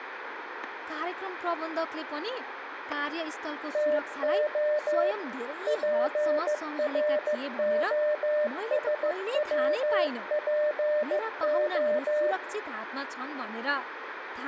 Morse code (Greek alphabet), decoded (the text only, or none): ΤΟ ΠΡΟΣΩΠΟ